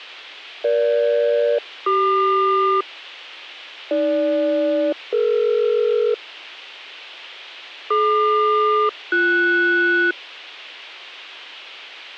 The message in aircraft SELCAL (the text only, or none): EG-CQ AG-DE DQ-BS